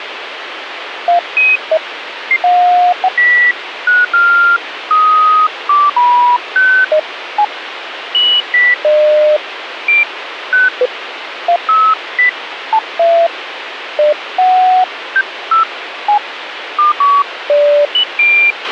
Electronic bleeps of random pitch and length, with radio hiss and a squelch burst at the end. There is no code.